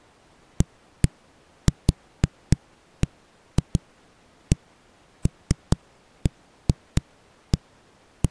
Irregular knocks on a wall. There is no code.